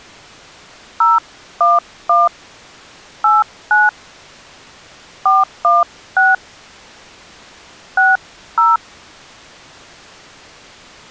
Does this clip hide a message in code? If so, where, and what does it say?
Yes: DTMF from 1.0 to 8.8 s, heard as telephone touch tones, dialled by hand, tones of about 180 ms. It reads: 011 89 416 60